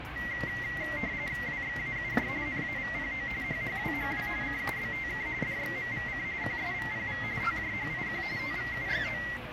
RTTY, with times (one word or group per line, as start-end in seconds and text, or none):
1.5-2.3 WXAUJ
2.5-3.3 NAVPO
3.4-4.3 HHWHW
4.4-5.3 CUBTK
5.4-6.2 DXMVC
6.4-7.2 QSVPV
7.4-8.2 TJHIQ
8.4-9.2 TVUGO